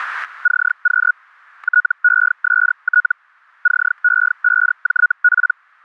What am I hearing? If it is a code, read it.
Hellschreiber (Feld-Hell, 122.5 baud), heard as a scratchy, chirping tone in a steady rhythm, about 1460 Hz, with static crashes. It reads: CQ TEST CE5JP